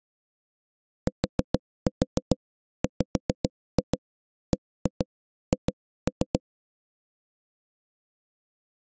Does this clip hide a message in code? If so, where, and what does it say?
Yes: tap code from 1.1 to 6.4 s, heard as knocks on wood, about 7 knocks a second. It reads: TWBH